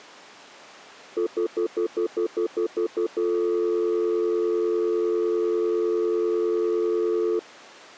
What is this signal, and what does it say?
Telephone call progress tone (North American plan), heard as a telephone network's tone, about 350, 440 Hz, 0.1 s on and 0.1 s off. Stutter dial tone.